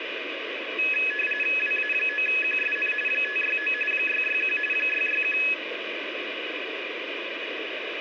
RTTY (45.45 baud, 850 Hz shift), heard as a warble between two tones, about 2100 Hz centre, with radio static. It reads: WA9QSN 569 661 661